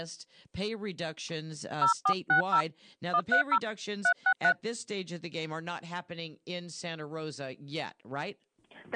DTMF, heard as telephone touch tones, dialled by hand, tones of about 90 ms. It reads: 0460 130 363